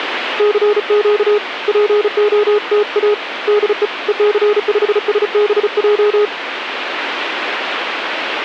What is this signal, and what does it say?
Morse code, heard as a keyed tone, hand-sent with a paddle, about 35 wpm, 420 Hz, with radio static. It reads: CQ POTA DE EC5SBJ